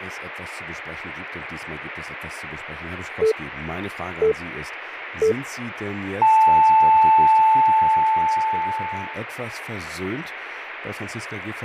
Radio time signal (three low pips and a long one an octave up, as on NHK), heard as pips, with speech in German.